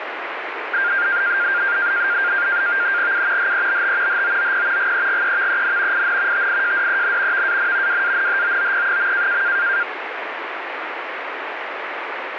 NAVTEX (SITOR-B), 100 baud, 170 Hz shift, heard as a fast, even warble, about 1500 Hz centre, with radio static. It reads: U HEBT HOOP GEGEVEN IN TIJDEN VAN WANHOOP.